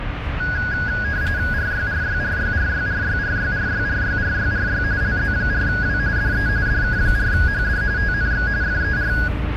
RTTY (45.45 baud, 170 Hz shift), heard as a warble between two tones, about 1550 Hz centre, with radio static and the noise inside a car. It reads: RYRYRYRYRYRYRYRYRYRY LZ4W DE DK4HD TNX FER